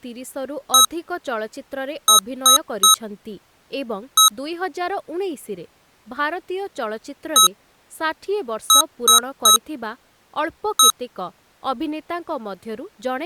Beep code, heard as beeps from a small speaker, played twice, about 1290 Hz, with speech in Odia. 1-3-1. In Phoenix BIOS tables: memory refresh failure.